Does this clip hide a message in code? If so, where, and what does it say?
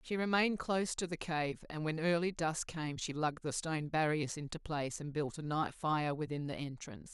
No, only speech in English.